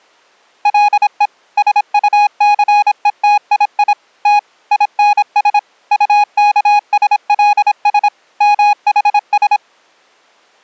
Morse code (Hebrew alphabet), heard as a keyed tone, machine-sent, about 26 wpm, 830 Hz. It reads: לו שטסותיי ת ינש טכשלש מחש